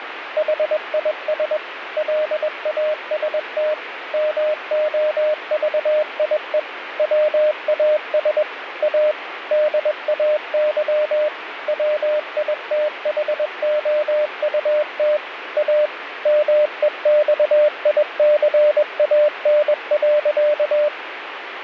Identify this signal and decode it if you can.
Morse code, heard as a keyed tone, machine-sent, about 21 wpm, 600 Hz, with radio static. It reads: HIS LAST MOVIE WAS A DAY WITHOUT A MEXICAN.